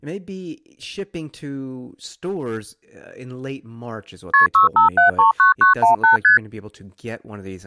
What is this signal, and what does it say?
Multi-frequency trunk signalling (R1, as on North American trunks), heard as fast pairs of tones, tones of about 130 ms, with speech in English. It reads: KP 65739918 ST